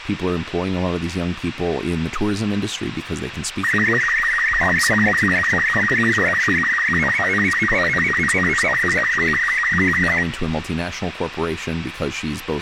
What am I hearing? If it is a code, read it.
SSTV (slow-scan television), Robot 36, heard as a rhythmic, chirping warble, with radio hiss, a squelch burst at the end, room echo and speech in English.